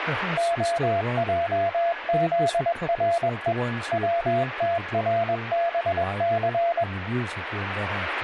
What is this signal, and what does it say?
Morse code (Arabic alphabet), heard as a keyed tone, machine-sent, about 21 wpm, 680 Hz, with radio static, a weaker station near 1690 Hz and speech in English. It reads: خجذرء وتربث